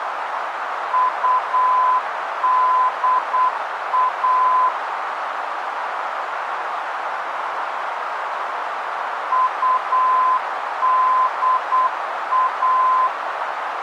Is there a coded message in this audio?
Yes: Morse code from 0.9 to 13.1 s, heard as a keyed tone, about 8 wpm, 1020 Hz, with radio static and a narrow filter. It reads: UDA UDA